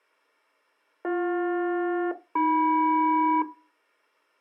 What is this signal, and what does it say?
Aircraft SELCAL, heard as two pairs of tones. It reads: BJ-AM